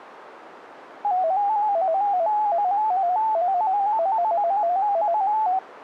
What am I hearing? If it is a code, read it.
Multi-tone FSK (Olivia or MFSK type), about 250 Hz wide, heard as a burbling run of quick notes, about 15.625 baud.